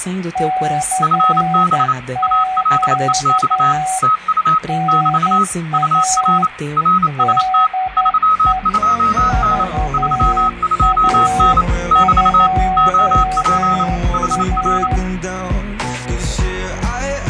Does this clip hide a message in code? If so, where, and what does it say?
Yes: Morse code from 0.3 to 15.0 s, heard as two keyed tones, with radio static and room echo. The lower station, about 11 wpm, 750 Hz: CQ NA DE VA2A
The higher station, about 28 wpm, 1280 Hz: FB ALEX TU <BT> UR RST 32N 32N <BT> OP HR